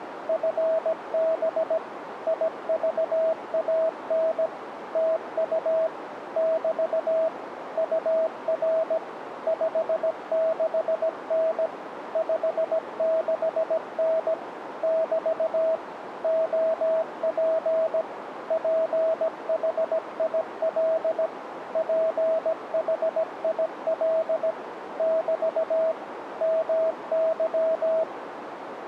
Morse code, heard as a keyed tone, machine-sent, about 17 wpm, 650 Hz, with radio static and a narrow filter. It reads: FB IVAN TU <BT> UR 56N 56N <BT> OP PHIL PHIL <BT> MY